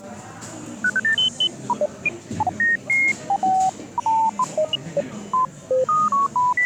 Electronic bleeps of random pitch and length, with the noise of a cafe. There is no code.